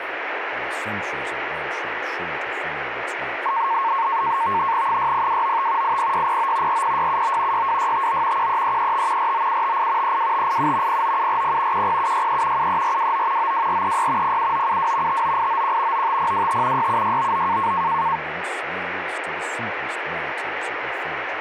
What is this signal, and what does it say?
NAVTEX (SITOR-B), 100 baud, 170 Hz shift, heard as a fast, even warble, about 1000 Hz centre, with radio static. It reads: 60295 80609 40679 62659 13335 49758 32587 09740 10763 73429 92436 07972 59891 95025 67699